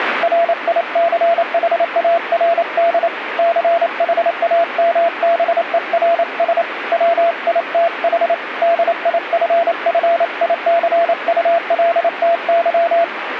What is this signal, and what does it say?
Morse code, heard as a keyed tone, hand-sent with a paddle, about 28 wpm, 680 Hz, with radio static. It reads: RICHARD CHAMBERS WITH DIFFICULTY